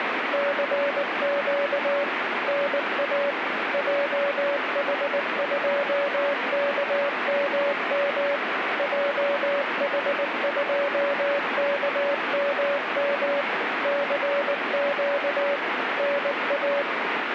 Morse code, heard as a keyed tone, machine-sent, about 19 wpm, 570 Hz, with radio static. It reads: CQ NA JH2KMM JH2KMM CQ NA